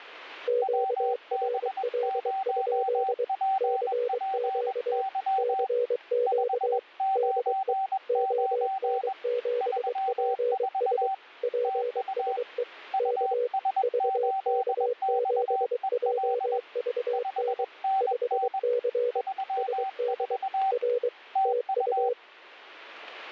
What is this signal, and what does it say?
Morse code, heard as two keyed tones, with static crashes. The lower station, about 23 wpm, 490 Hz: QRL? CQ CQ DE ON7PS PSE K VK7JVN 5C SD R TU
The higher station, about 21 wpm, 770 Hz: WB0PPY 599 34 TU US8XEL 5NN 34 TU